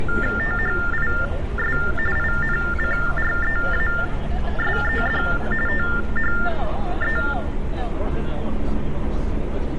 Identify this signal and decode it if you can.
TTY/TDD text telephone tones (45.45 baud Baudot), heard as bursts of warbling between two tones, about 400 Hz shift, 1600 Hz centre, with room echo and street noise. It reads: THIS INCREASED THE